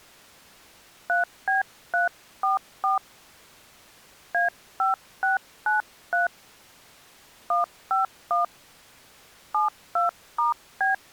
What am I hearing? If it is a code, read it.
DTMF, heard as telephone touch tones, dialled by hand, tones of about 140 ms. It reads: 3B344 A5693 151 72*B